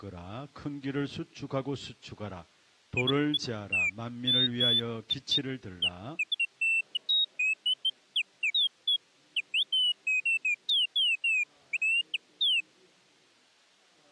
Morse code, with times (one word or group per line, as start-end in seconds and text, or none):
none